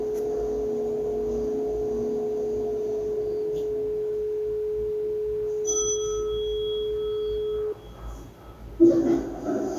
Telephone call progress tone (425 Hz plan, as in most of Europe), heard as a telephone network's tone, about 420 Hz, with room echo and the noise inside a lift. Dial tone.